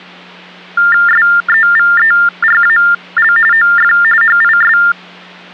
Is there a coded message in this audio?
Yes: TTY/TDD text telephone tones (45.45 baud Baudot) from 0.8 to 4.9 s, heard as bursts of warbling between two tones, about 400 Hz shift, 1600 Hz centre, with hum. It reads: SEVERAL OF HIS